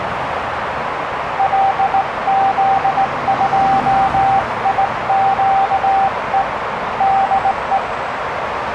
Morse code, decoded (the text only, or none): LZ2IQE DE